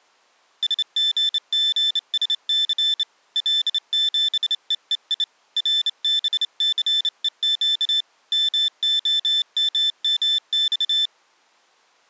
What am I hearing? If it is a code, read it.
Morse code, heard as a high beeper, hand-sent with a straight key, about 28 wpm, 3550 Hz. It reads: SGGSC L7EEI RBCEQ MOMMX